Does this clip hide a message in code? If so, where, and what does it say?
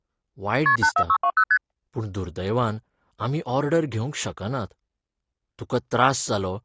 Yes: multi-frequency trunk signalling (R1, as on North American trunks) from 0.7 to 1.6 s, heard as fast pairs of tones, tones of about 70 ms, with speech in Goan Konkani. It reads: KP 84620 ST